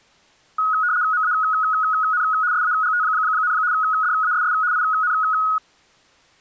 RTTY (75 baud, 170 Hz shift), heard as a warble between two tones, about 1360 Hz centre. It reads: MAN SAGT, DASS IN